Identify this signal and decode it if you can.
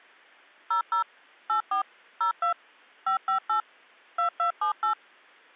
DTMF, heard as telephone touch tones, dialled by machine, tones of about 110 ms. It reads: 00 84 02 558 2278